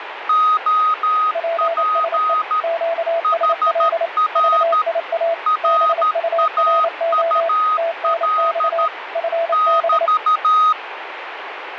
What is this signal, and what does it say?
Morse code, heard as two keyed tones, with radio static. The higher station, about 13 wpm, 1250 Hz: OP HR RAUL <BT>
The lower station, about 28 wpm, 670 Hz: PSE QSL VIA BURO TNX FB